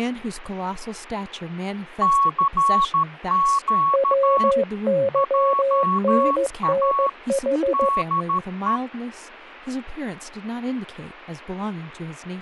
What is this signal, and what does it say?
Morse code, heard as two keyed tones, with radio static and speech in English. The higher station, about 13 wpm, 1110 Hz: CQ JA DE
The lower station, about 15 wpm, 550 Hz: WYNNH